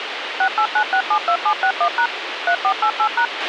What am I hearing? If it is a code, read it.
DTMF, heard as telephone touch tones, dialled by machine, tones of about 80 ms, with radio hiss and a squelch burst at the end. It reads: 689672761# 3488#